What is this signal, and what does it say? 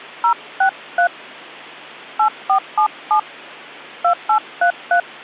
DTMF, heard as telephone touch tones, dialled by hand, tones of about 90 ms. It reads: 063 8477 2833